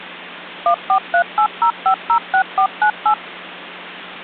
DTMF, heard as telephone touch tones, dialled by machine, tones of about 90 ms. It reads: 14380506498